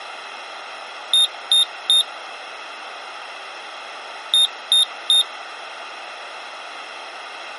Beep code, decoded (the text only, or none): 3 short